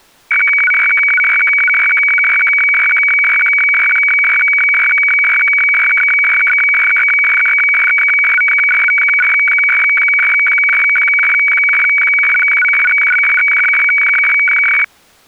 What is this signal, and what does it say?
Weather fax (radiofax), 120 lines a minute, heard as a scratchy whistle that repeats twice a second.